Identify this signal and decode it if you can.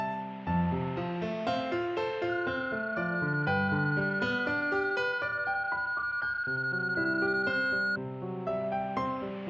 PSK31 (31.25 baud), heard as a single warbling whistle, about 1440 Hz.